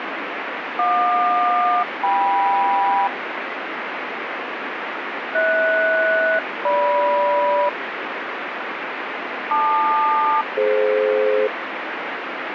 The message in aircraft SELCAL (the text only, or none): JQ-KM HS-GM LQ-DF